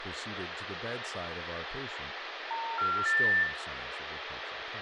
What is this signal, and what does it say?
Telephone call progress tone (North American plan), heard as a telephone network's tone, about 910, 1370, 1800 Hz, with phone line noise, room echo and speech in English. Special information tone.